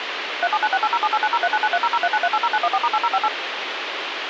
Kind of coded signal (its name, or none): DTMF